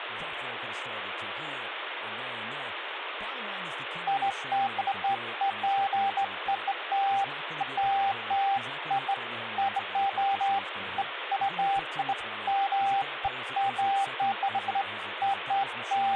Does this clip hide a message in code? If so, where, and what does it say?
No, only beeps of irregular length, with phone line noise and speech in English.